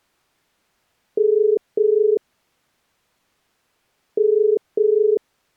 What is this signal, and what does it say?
Telephone call progress tone (as in the UK, Ireland, Australia and similar networks), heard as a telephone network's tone, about 430 Hz. Ringback tone.